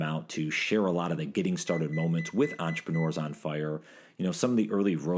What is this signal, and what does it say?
Beep code, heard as a piezo beeper, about 2000 Hz, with room echo and speech in English. 6 short. In AMI BIOS tables: keyboard controller gate A20 failure; in Dell tables: video card failure.